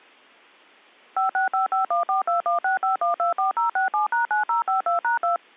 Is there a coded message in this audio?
Yes: DTMF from 1.2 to 5.4 s, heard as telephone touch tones, dialled by machine, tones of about 130 ms. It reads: 5655142165124067#9052#2